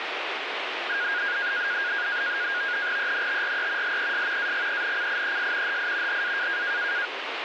NAVTEX (SITOR-B), 100 baud, 170 Hz shift, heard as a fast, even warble, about 1550 Hz centre, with radio static. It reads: ENTRE LES AGENCIES HI HA